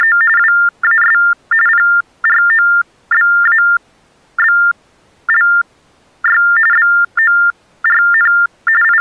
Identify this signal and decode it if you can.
TTY/TDD text telephone tones (45.45 baud Baudot), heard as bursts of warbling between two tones, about 400 Hz shift, 1600 Hz centre. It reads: … WAS PROBABLY BORN …